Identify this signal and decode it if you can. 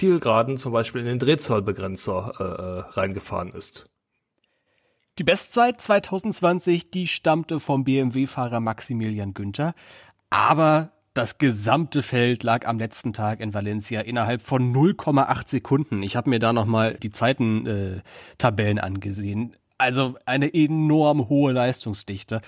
Speech in German. There is no code.